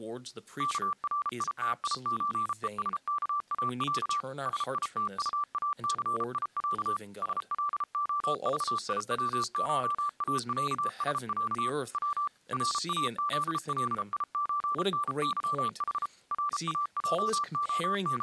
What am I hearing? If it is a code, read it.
Morse code (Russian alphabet), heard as a keyed tone, machine-sent, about 33 wpm, 1170 Hz, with speech in English. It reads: КРИТИЧЕСКАЯ СИТУАЦИЯ СЛОЖИВШАЯСЯ В РАЗЛИЧНЫХ …